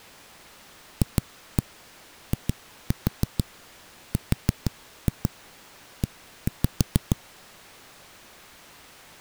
Tap code, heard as knocks on a wall, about 6 knocks a second. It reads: FIRE